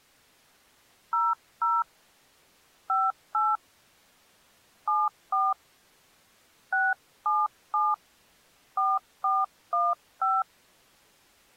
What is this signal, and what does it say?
DTMF, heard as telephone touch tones, dialled by hand, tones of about 210 ms. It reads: 00 58 74 677 4415